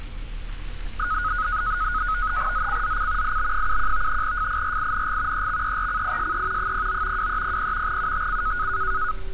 NAVTEX (SITOR-B), 100 baud, 170 Hz shift, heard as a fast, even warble, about 1360 Hz centre, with street noise. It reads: ZCZC IB71 FIRING EXERCISE 09 2300 UTC